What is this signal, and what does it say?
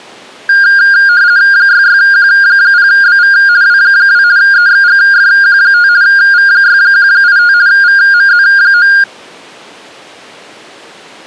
RTTY (50 baud, 170 Hz shift), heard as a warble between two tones, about 1500 Hz centre. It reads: 66Q0BV W2 EXGFQ5 V6185 VMZ9